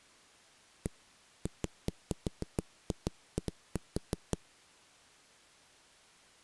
Irregular knocks on a wall. There is no code.